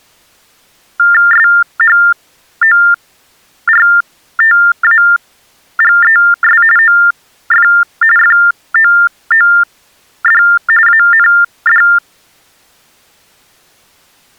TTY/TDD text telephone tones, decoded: SHORTAGES OF FOOD AND

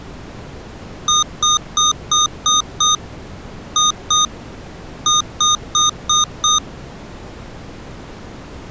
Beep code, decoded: 6-2-5

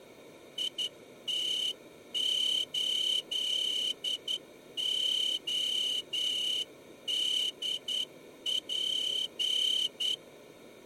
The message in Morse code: IT8ODP

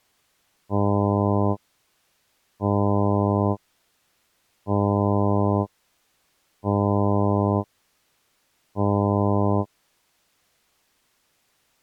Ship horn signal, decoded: 5 short

